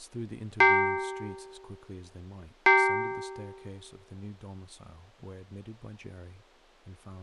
Clock strike, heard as a bell, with speech in English. 2. Two o'clock.